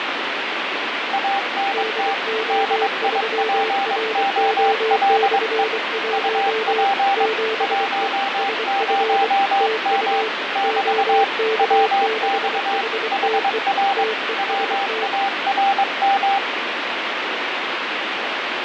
Morse code, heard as two keyed tones, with radio static. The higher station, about 22 wpm, 790 Hz: ANT DIPOLE UP 10M <BT> WX HR WARM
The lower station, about 24 wpm, 440 Hz: DO3RO/1 7E SF TU OK6HTE TEST